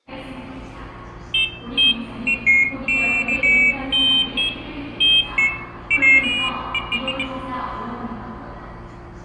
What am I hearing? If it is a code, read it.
Pairs of high tones at irregular times, with room echo and the noise of a subway station. There is no code.